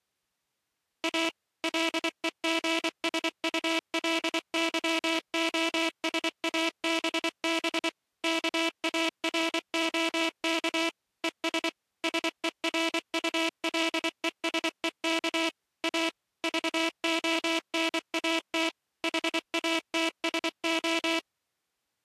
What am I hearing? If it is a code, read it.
Morse code, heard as a buzzer, machine-sent, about 24 wpm. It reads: A LEGSULYOSABB KAROK ES SERULESEK A VONAT HATSO